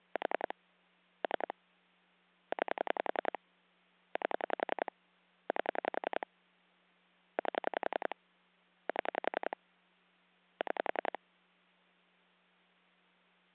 Pulse dialling, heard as clicks on a phone line, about 10 pulses a second, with hum. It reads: 4 3 9 8 8 8 7 6